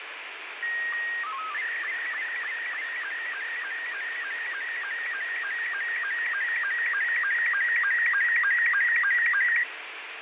SSTV (slow-scan television), Robot 72, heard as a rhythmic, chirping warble, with heavy radio static and fading.